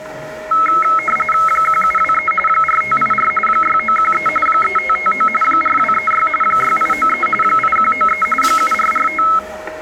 RTTY (45.45 baud, 850 Hz shift), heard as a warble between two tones, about 1750 Hz centre, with static crashes, a steady whistle near 620 Hz and the noise of a crowd indoors. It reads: 1723 4584 6913 3559 4236 6893 8193 7445